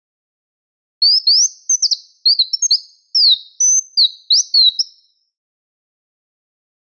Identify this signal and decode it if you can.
Bird-like chirps. There is no code.